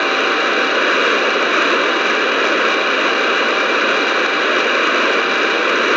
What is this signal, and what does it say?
Morse code (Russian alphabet), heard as a keyed tone, hand-sent with a straight key, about 22 wpm, 780 Hz, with heavy radio static. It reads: … С ДЕТЬМИ В